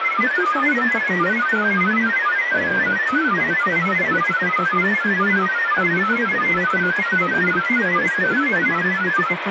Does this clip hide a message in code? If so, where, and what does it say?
Yes: multi-tone FSK (Olivia or MFSK type), about 1000 Hz wide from 0.0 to 9.4 s, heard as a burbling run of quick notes, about 31.25 baud, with radio static and speech in Arabic.